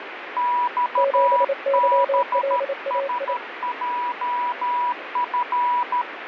Morse code, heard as two keyed tones, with radio static. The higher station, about 13 wpm, 980 Hz: XBSJF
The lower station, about 28 wpm, 550 Hz: 7YLAI